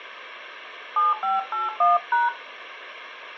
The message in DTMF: 7581#

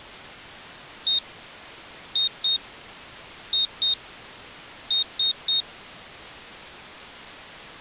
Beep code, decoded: 1-2-2-3

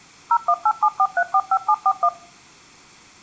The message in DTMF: 01874345741

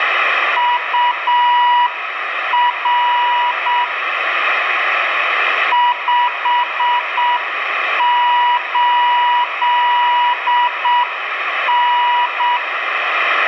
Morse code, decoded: UR 58N

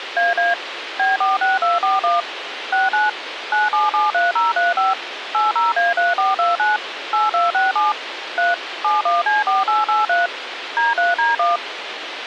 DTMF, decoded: AA B46241 69 9773035 80A3429 8267 3 71C4883 D3D1

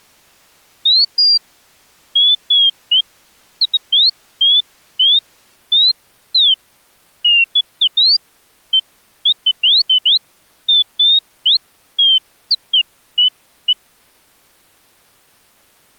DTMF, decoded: none

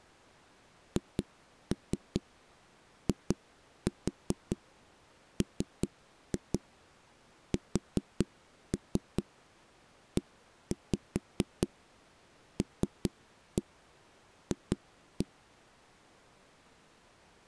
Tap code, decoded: HIMSELF

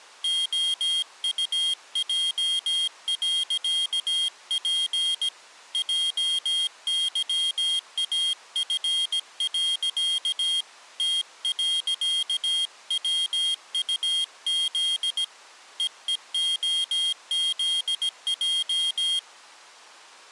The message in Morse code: OUJ.P JYAF. T.WUZ EEOZJ

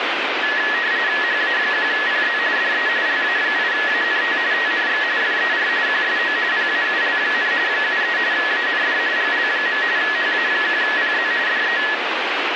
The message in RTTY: HA1PZ DE LA8ANT TNX FER QSO PAUL, 73 AND GL. HA1PZ DE

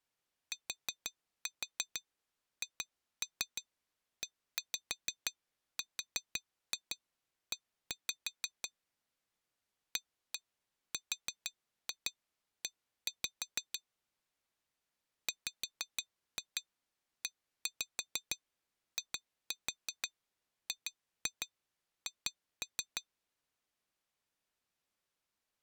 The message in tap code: THERE ARE WEIGH

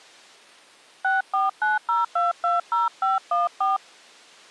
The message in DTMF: 6490220514

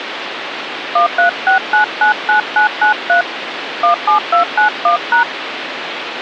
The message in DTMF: 136999993 17291#

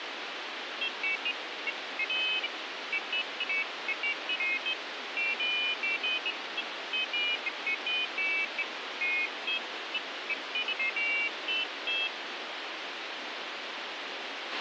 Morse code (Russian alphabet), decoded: none

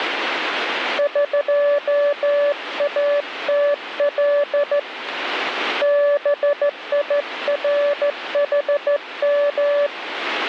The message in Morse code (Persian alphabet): قاتل بیرحم

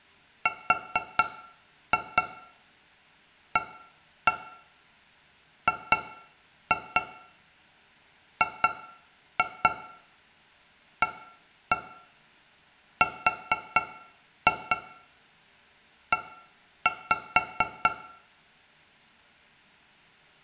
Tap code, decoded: RAGGARE

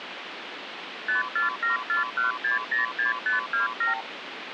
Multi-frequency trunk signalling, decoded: 54741606527

